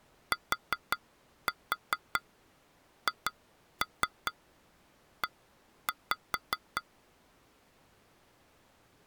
Tap code, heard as taps on glass, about 4 knocks a second. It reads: THE